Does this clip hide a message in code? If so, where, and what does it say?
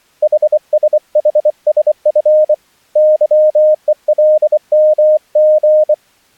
Yes: Morse code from 0.2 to 6.0 s, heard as a keyed tone, hand-sent with a bug key, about 24 wpm, 620 Hz. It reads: HSHSF YELMG